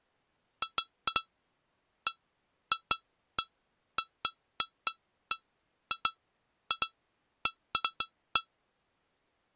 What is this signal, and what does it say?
Irregular taps on glass. There is no code.